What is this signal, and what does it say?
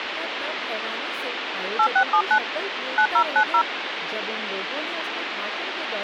DTMF, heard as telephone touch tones, dialled by hand, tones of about 80 ms, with phone line noise and speech in Hindi. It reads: 8679 9090